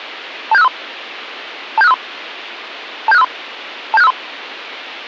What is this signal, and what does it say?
Five-tone selective call (EIA), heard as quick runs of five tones, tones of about 30 ms. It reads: 27653 27653 27653 27653